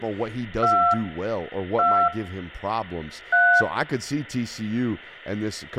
DTMF, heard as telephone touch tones, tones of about 260 ms, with room echo and speech in English. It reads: 2 2 3